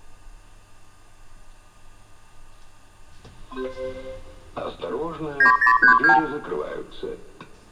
Multi-frequency trunk signalling (R2, with the far end's replies), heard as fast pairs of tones, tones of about 110 ms. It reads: 9032